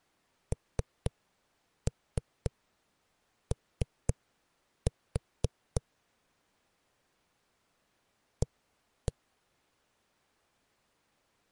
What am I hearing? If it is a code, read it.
Tap code, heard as knocks on a wall, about 3 knocks a second. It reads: NO A